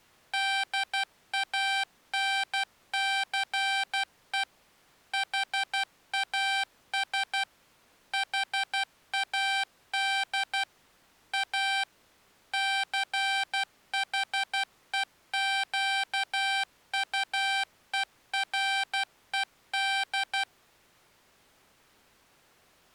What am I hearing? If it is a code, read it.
Morse code, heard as electronic beeps, machine-sent, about 12 wpm, 780 Hz. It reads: DANCE HAS HAD A CHEQUERED